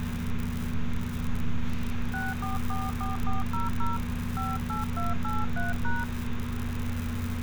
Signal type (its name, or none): DTMF